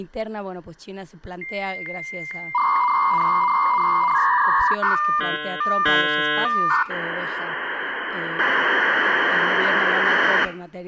Dial-up modem handshake (V.34 or later), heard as a whistle, warbles, then hiss, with room echo and speech in Spanish.